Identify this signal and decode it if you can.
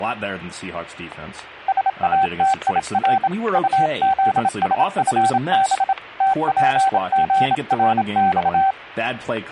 Morse code, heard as a keyed tone, hand-sent with a bug key, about 27 wpm, 770 Hz, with static crashes and speech in English. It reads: SATIR UZSFB TPGRX